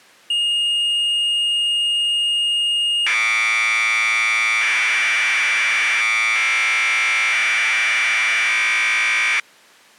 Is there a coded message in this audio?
Yes: Commodore tape loading (standard loader) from 0.3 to 9.4 s, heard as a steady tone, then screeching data.